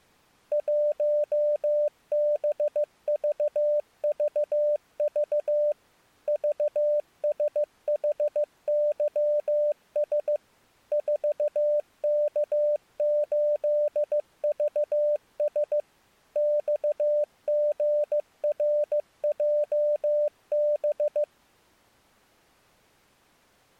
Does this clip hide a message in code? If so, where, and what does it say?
Yes: Morse code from 0.5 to 21.3 s, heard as a keyed tone, machine-sent, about 15 wpm, 590 Hz. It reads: 1BVVV VSHYS 4K8VS XGRJB